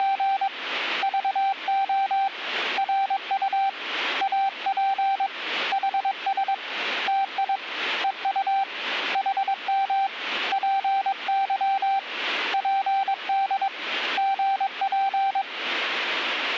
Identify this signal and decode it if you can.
Morse code, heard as a keyed tone, hand-sent with a paddle, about 22 wpm, 780 Hz. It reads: … VO RU AP HS TI EU HM PY PD GP